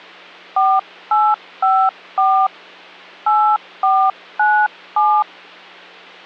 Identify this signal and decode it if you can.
DTMF, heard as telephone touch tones, dialled by hand, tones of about 280 ms, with hum. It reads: 4854 8497